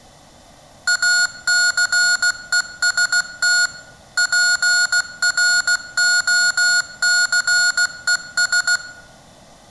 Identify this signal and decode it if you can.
Morse code, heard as electronic beeps, machine-sent, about 16 wpm, 1440 Hz, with room echo. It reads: ACEST PROCES